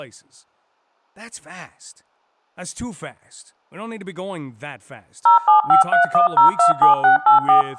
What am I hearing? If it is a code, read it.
DTMF, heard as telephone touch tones, dialled by machine, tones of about 120 ms, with speech in English. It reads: 07531027684